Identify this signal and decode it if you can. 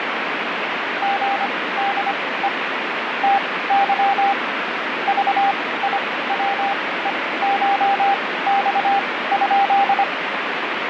Morse code (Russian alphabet), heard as a keyed tone, machine-sent, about 25 wpm, spaced as for 17 wpm, 800 Hz, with radio static. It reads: ГДЕ ТЫ ЖИВЕШЬ?